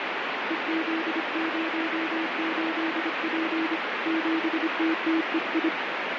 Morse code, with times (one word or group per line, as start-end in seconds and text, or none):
0.5-3.8 EZ08P
4.1-5.7 7TTEI